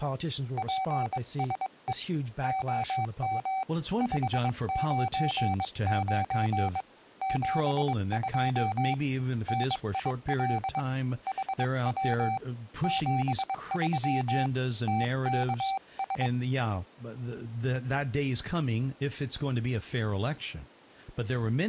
Morse code, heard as a keyed tone, hand-sent with a bug key, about 22 wpm, 770 Hz, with speech in English. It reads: PSE OM 599 72 NIL HW 73 TKS